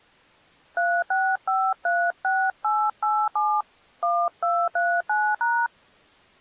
DTMF, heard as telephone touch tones, dialled by hand, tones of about 250 ms. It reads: 36536887 1239#